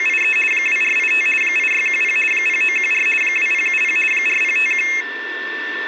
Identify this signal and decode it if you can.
RTTY (50 baud, 450 Hz shift), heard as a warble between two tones, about 2350 Hz centre, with a steady whistle near 1780 Hz. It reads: … 2485 8610 0914 2070 4051